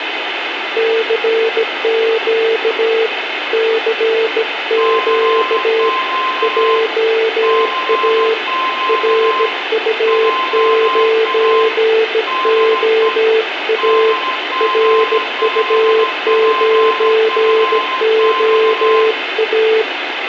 Morse code, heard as two keyed tones, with radio static and room echo. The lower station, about 17 wpm, 450 Hz: CQ CQ JA RU9OA RU9OA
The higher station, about 16 wpm, 1040 Hz: CQ CQ JA DE DG5PFX